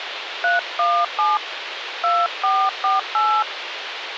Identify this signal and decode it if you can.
DTMF, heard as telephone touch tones, dialled by hand, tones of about 210 ms, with radio hiss. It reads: 317 2448